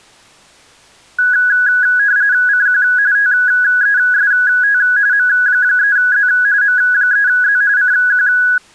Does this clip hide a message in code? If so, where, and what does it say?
Yes: RTTY (45.45 baud, 170 Hz shift) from 1.2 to 8.6 s, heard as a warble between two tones, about 1550 Hz centre. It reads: CQ TEST M3Z M3Z CQ